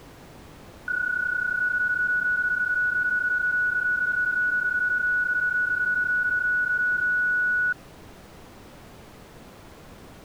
PSK31 (31.25 baud), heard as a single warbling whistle, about 1470 Hz.